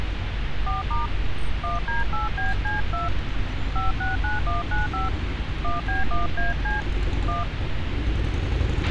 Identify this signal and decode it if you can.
DTMF, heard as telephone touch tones, dialled by hand, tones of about 160 ms, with radio hiss, a squelch burst at the end and street noise. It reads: 4* 1D8BC2 569195 1B1AC 1